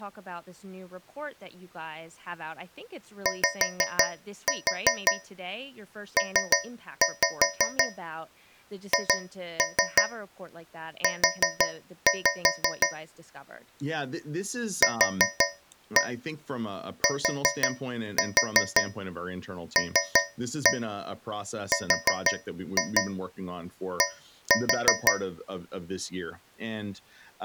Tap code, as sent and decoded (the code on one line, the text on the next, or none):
5-4 3-5 2-3 4-5 / 4-1 4-4 3-1 4-2 1-4
YPHU QTLRD